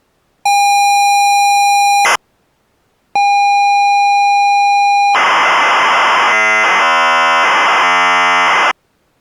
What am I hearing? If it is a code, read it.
ZX Spectrum tape loading, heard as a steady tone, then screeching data.